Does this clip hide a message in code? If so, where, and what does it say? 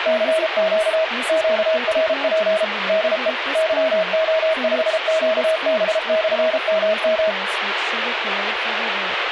Yes: Morse code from 0.0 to 7.4 s, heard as a keyed tone, machine-sent, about 33 wpm, 640 Hz, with radio static and speech in English. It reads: CQ QRP DE YO5QB/MM